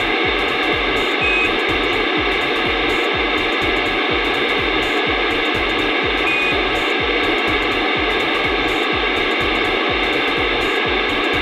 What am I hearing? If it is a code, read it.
Quindar tones, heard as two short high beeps, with radio hiss.